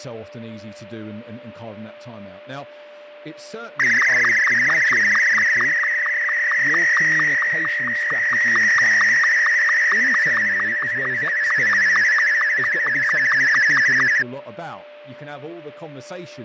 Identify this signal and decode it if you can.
SSTV (slow-scan television), Martin M2, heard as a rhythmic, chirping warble, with fading, a steady whistle near 590 Hz and speech in English.